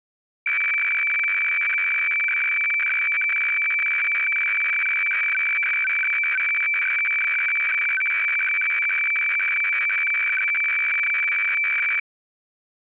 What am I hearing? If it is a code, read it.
Weather fax (radiofax), 120 lines a minute, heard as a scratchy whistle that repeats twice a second.